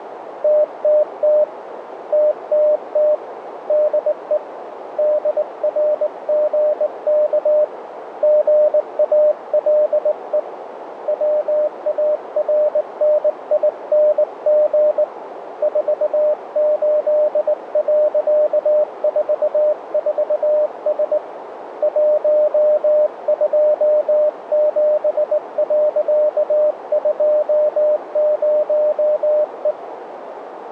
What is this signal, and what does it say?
Morse code, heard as a keyed tone, hand-sent with a straight key, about 19 wpm, 600 Hz, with radio static and a narrow filter. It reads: TTT TTT DE DRGK GALE WARNING 48.44S 127.20E